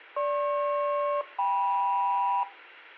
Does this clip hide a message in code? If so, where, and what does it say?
Yes: aircraft SELCAL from 0.2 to 2.4 s, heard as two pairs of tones. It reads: GP-KM